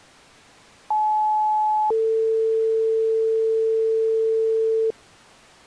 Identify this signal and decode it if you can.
Two-tone page, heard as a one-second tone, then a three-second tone, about 860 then 450 Hz.